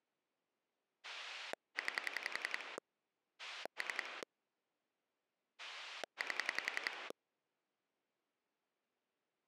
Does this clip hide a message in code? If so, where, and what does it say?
Yes: pulse dialling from 1.0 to 7.1 s, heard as a rotary dial, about 11 pulses a second. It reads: 9 3 8